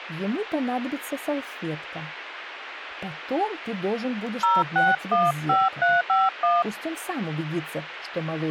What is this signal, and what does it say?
DTMF, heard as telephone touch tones, dialled by hand, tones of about 200 ms, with radio hiss. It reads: 0615351